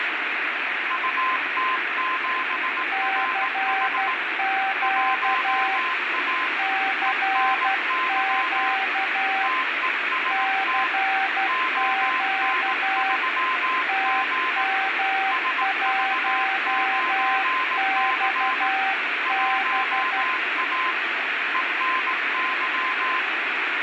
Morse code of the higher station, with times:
0.9-4.1 UT7RH
4.8-6.5 1A
7.1-8.7 ENY
9.4-10.9 TEST
11.5-14.6 ON3G
15.3-18.7 SV9C
19.3-20.9 1A
21.5-23.2 ENY

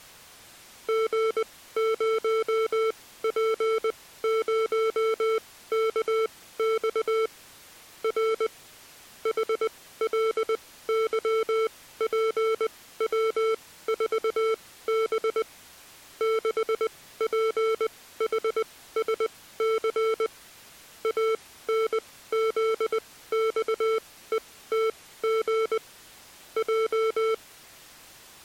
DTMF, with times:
none

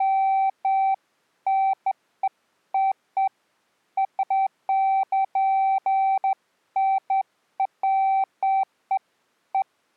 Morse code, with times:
none

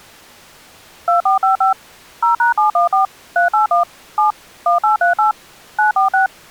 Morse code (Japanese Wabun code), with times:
none

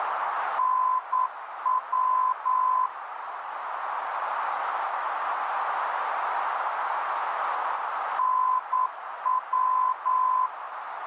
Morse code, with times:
0.6-2.9 NW
8.2-10.5 NW

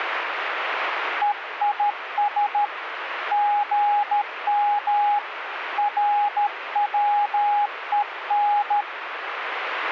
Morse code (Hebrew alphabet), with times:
1.2-2.6 ויש
3.3-5.2 גם
5.8-8.8 רצון

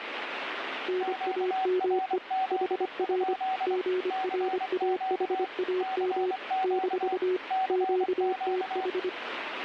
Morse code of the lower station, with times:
0.9-2.2 NAME
2.5-3.3 HR
3.7-6.3 GRAHAM
6.6-7.4 -
7.7-9.1 QTH

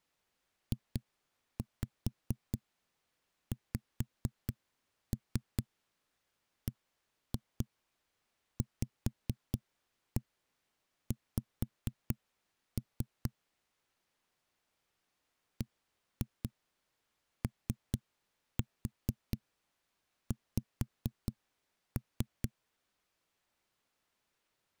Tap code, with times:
0.7-13.3 JXBVX
15.6-22.5 BOX

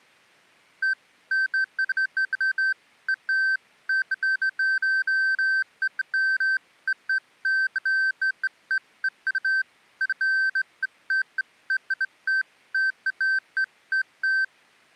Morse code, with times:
none

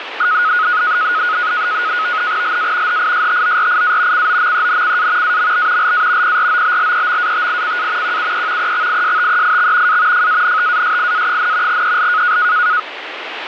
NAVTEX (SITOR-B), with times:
2.4-3.0 LA
2.9-4.3 HISTORIA
4.1-5.4 COMENCA
5.2-5.9 AMB
5.8-6.4 LA
6.2-8.2 PROBLEMATICA
8.0-8.7 QUE
8.6-10.0 EXISTEIX
9.9-10.3 A
10.1-11.8 FANTASIA,
11.7-12.4 EL

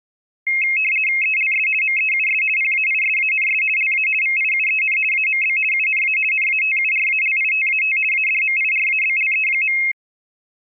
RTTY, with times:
1.2-1.7 ELS
1.8-2.4 MEUS
2.6-3.6 PAISANS
3.8-4.1 LA
4.2-5.0 VIUEN
5.1-5.6 AMB
5.7-6.2 UNA
6.3-8.0 NATURALITAT
8.1-9.8 ADMIRABLE.

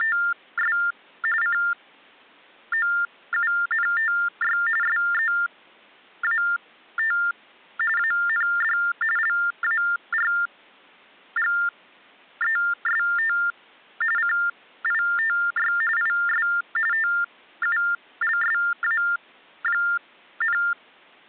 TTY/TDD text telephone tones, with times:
0.0-0.8 …
1.4-4.6 COUNTY
4.8-7.2 SEAT
8.0-8.8 AND
9.2-13.4 LARGEST
14.2-15.7 CITY
16.0-16.5 IS
16.9-20.6 TULSA,

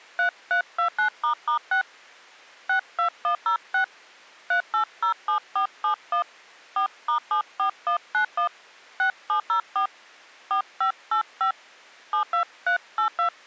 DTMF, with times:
0.2-1.8 3329**6
2.7-3.8 62106
4.5-6.2 3807471
6.8-8.5 4*74191
9.0-9.9 6704
10.5-11.5 4585
12.1-13.3 72382

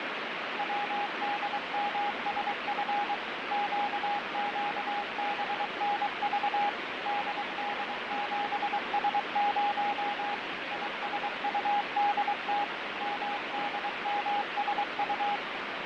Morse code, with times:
0.6-3.1 WDMSF
3.5-6.7 QQBNV
7.1-10.3 DD7S0
10.7-12.6 ISUDT
13.0-15.4 MDMSU

